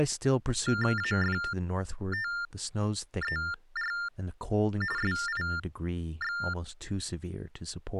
TTY/TDD text telephone tones (45.45 baud Baudot), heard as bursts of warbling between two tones, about 400 Hz shift, 1600 Hz centre, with speech in English. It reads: AFTER SIX